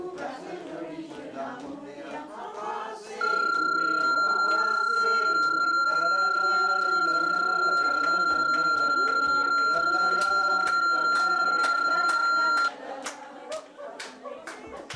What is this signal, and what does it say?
PSK31 (31.25 baud), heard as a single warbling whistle, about 1380 Hz.